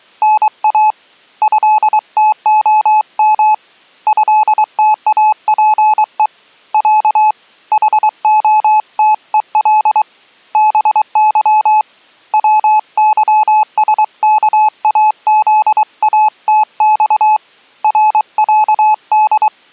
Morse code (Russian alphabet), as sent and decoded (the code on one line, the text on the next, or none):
-. .- / ..-.. - --- -- / ..-.. - .- .--. . / .-.- / .... --- - . .-.. / -... -.-- / .-- -.-- ... -.- .- --.. .- - -..- / .-. .-.- -..
НА ЭТОМ ЭТАПЕ Я ХОТЕЛ БЫ ВЫСКАЗАТЬ РЯД